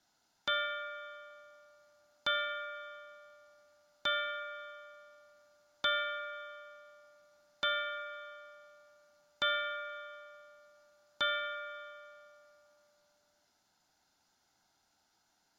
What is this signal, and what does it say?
Clock strike, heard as a bell, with room echo. 7. Seven o'clock.